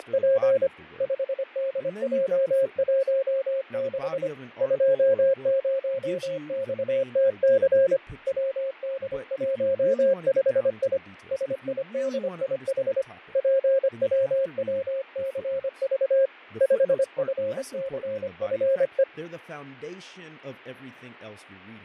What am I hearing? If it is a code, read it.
Morse code, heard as a keyed tone, hand-sent with a paddle, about 25 wpm, 540 Hz, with fading and speech in English. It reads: … 5DJ16 20XTC WD15I SIDIH PWWCV 5FCFE